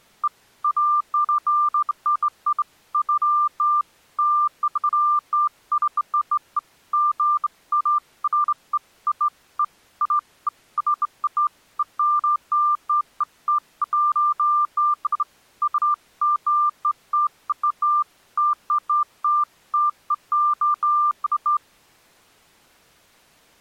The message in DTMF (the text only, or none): none